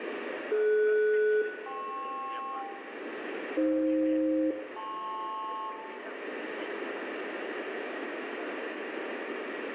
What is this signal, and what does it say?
Aircraft SELCAL, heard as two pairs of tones, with radio static and room echo. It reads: DS-KP AF-LP